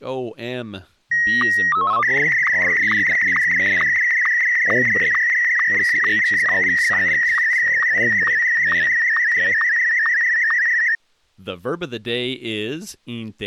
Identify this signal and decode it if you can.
SSTV (slow-scan television), Martin M1, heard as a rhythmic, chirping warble, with speech in English.